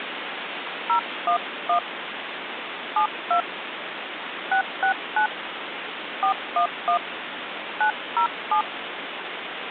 DTMF, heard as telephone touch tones, dialled by hand, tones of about 100 ms, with phone line noise. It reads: 011 72 669 411 907